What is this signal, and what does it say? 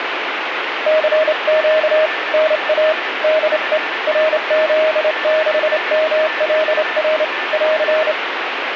Morse code, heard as a keyed tone, hand-sent with a straight key, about 28 wpm, 630 Hz, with radio static and a weaker station near 1770 Hz. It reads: CQ NA DE RZ6MLR <AR>